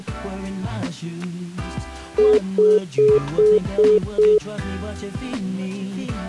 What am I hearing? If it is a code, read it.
Telephone call progress tone (single-tone plan, as in most of Europe), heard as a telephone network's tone, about 420 Hz, 0.2 s on and 0.2 s off. Congestion tone.